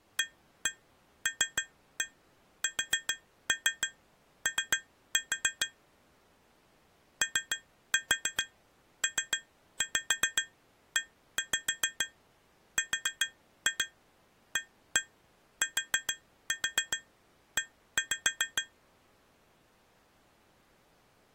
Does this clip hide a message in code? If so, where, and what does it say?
Yes: tap code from 0.2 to 18.8 s, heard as taps on glass, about 7 knocks a second. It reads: ALSO OPERATE